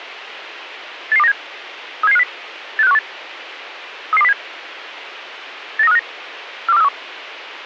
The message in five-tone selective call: 88297 37750 86518 33207 89359 42431

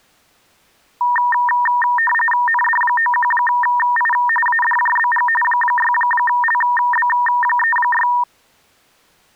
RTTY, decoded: ND91I ADJBG 6LB36

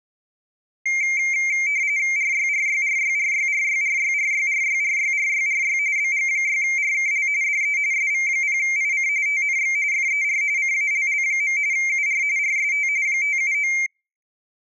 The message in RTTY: RYRYRYRYRYRYRYRYRYRYRY BG6RKL DE SV0IC TNX FER CALL. UR RST 579

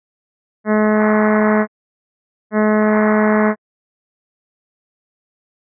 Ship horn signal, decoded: 2 short

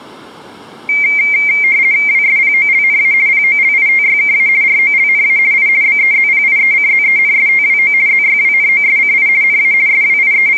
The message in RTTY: WSPOLNA POLITYKA ROLNA I BEZPIECZENSTWO ZYWNOSCI NA …

